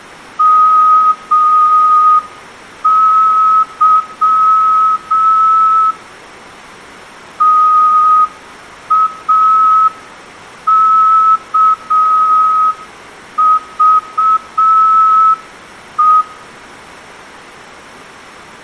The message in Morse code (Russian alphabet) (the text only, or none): МЫ ТАКЖЕ